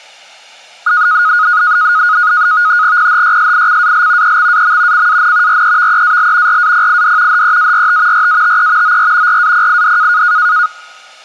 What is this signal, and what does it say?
NAVTEX (SITOR-B), 100 baud, 170 Hz shift, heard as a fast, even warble, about 1350 Hz centre. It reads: PHYSICAL EXAM CAN REVEAL RAPID HEART RATE OR RAPID